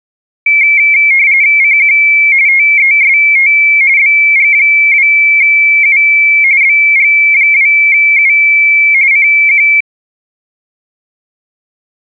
RTTY (45.45 baud, 170 Hz shift), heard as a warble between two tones, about 2250 Hz centre. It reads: CQ TEST BG2U BG2U CQ